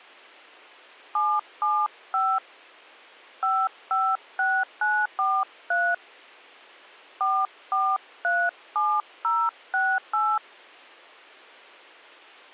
DTMF, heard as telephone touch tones, dialled by hand, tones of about 240 ms. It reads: 775 556943 4437068